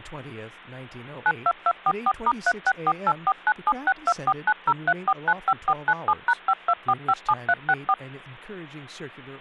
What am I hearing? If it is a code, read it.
DTMF, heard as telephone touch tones, dialled by machine, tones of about 50 ms, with hum and speech in English. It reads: 92244*3648497624903495497#52457364